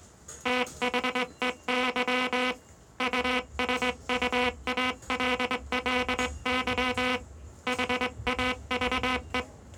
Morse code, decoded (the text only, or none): THEY USUALLY HAVE